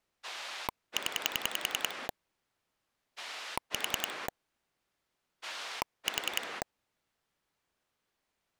Pulse dialling, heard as a rotary dial, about 10 pulses a second. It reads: 0 4 4